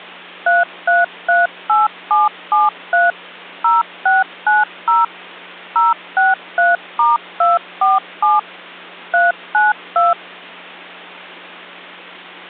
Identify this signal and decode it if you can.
DTMF, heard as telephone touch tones, dialled by machine, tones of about 170 ms, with hum. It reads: 3338773 0690 063*247 392